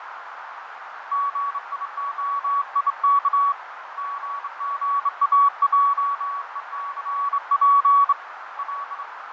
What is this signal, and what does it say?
Morse code, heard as a keyed tone, hand-sent with a straight key, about 26 wpm, 1130 Hz, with radio static, fading and a narrow filter. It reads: GIOIK GGAJECP L